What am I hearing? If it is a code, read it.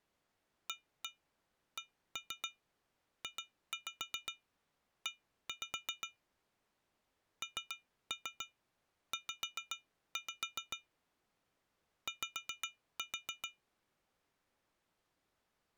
Tap code, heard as taps on glass, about 7 knocks a second. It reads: ACJE NZ Y